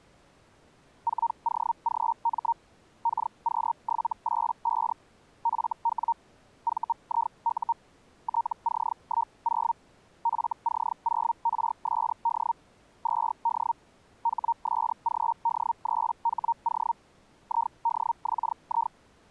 Hellschreiber (Feld-Hell, 122.5 baud), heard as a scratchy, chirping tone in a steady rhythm, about 930 Hz. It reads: 4OGM KQ785 FW VIU TC10 FC0RSD 2D HSGD3HO IDXI